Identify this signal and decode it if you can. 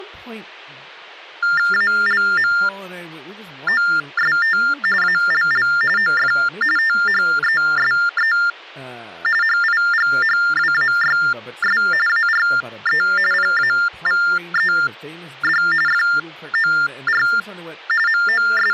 TTY/TDD text telephone tones (45.45 baud Baudot), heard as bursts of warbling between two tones, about 400 Hz shift, 1600 Hz centre, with hum and speech in English. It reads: ALMOST ALL OF THESE HIGHWAYS ARE PAVED FOR …